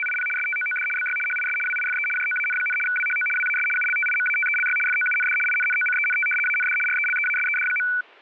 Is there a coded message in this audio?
Yes: RTTY (75 baud, 850 Hz shift) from 0.0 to 8.0 s, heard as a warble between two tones, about 1900 Hz centre. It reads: … STOOD BY HIS WIFE JOAN, WHO WAS ULTIMATELY FOUND INNOCENT AND RELEASED.